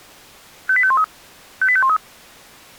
Five-tone selective call (ZVEI), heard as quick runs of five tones, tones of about 70 ms. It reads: 58513 58513